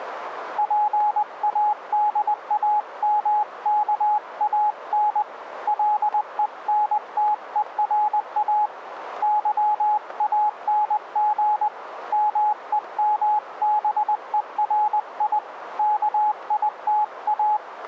Morse code, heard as a keyed tone, hand-sent with a paddle, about 20 wpm, 840 Hz, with radio static. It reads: PADAMKAN LENTERA YANG MEMBERI KITA